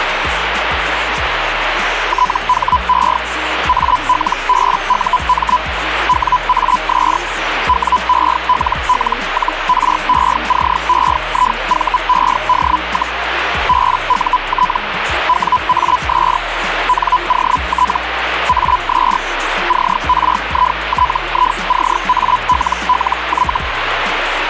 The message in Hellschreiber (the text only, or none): THE ALBUM WAS WELL-RECEIVED, BUT WAS NOT AS CRITICALLY